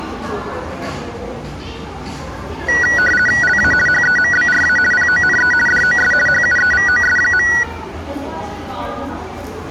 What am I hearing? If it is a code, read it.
RTTY (50 baud, 450 Hz shift), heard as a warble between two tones, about 1700 Hz centre, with the noise of a crowd indoors. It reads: LA HEMBRA PONE DOS HUEVOS.